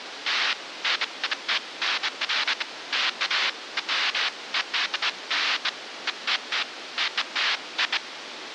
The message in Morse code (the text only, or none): none